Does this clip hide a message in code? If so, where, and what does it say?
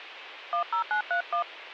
Yes: DTMF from 0.5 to 1.4 s, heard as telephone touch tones, dialled by hand, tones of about 100 ms. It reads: 10931